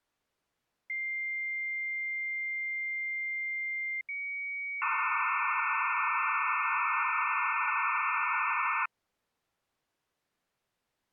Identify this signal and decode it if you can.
Dial-up modem handshake (low-speed, two carriers), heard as two whistles, then hiss.